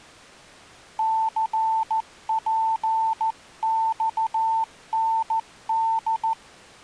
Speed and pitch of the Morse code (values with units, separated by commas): 14 wpm, 890 Hz